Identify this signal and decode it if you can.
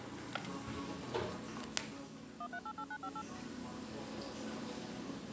DTMF, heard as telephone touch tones, dialled by machine, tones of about 60 ms, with the noise of a cafe. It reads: 1388958